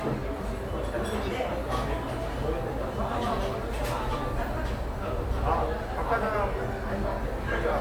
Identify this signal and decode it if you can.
The noise of a cafe. There is no code.